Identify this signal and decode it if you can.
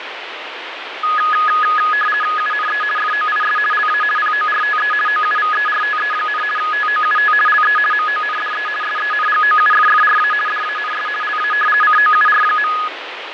RTTY (50 baud, 450 Hz shift), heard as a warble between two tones, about 1470 Hz centre, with radio static and fading. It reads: UNE FOIS LA PORTE OUVERTE, TOUT LE MONDE SENGOUFFRA DANS LA COUR.